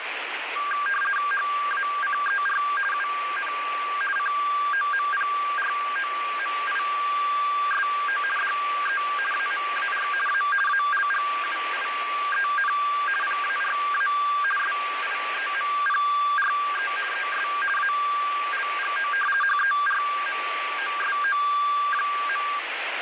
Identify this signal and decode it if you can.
RTTY (50 baud, 450 Hz shift), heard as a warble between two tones, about 1380 Hz centre, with radio static. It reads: HACER UN COMPROMISO DE AMAR A ALGUIEN PARA SIEMPRE ES ALGO HERMOSO.